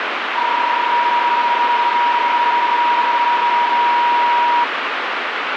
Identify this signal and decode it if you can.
PSK31 (31.25 baud), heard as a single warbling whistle, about 960 Hz, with radio static.